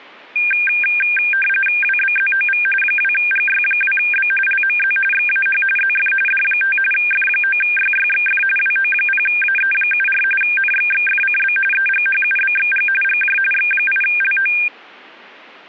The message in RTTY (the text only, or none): WBZOV 2GY2B LMZ XAH ZF D5 F9YYXF WO0AE74 NXXFCB EGHUBXG GJ X8LO